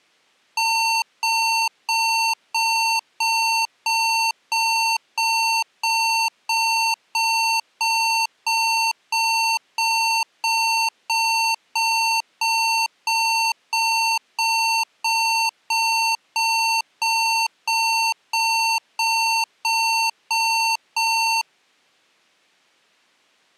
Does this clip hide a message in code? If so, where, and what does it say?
No, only evenly repeated beeps.